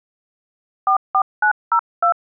DTMF, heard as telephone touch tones, dialled by hand, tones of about 80 ms. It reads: 44902